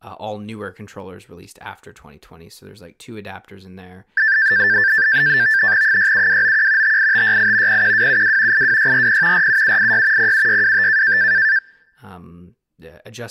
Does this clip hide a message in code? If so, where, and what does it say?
Yes: NAVTEX (SITOR-B), 100 baud, 170 Hz shift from 4.2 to 11.6 s, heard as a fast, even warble, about 1650 Hz centre, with speech in English. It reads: 67291 58568 01272 82640 47786 07625